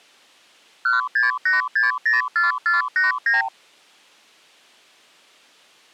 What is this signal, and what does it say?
Multi-frequency trunk signalling (R2, with the far end's replies), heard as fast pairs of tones, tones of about 150 ms. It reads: 168604489